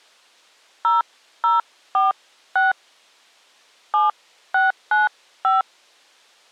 DTMF, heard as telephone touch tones, dialled by hand, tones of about 160 ms. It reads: 0046 7695